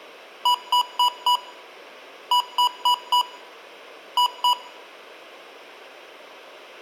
Beep code, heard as beeps from a small speaker, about 980 Hz, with room echo. 4-4-2. In Phoenix BIOS tables: parallel port failure.